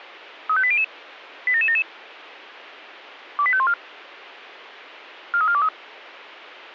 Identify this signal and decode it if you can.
Five-tone selective call (ZVEI), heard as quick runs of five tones, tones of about 70 ms. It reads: 35800 87777 28514 43423